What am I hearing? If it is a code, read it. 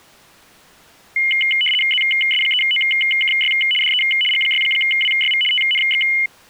RTTY (75 baud, 850 Hz shift), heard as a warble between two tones, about 2550 Hz centre. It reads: ZS3OKY DE G6WYV TNX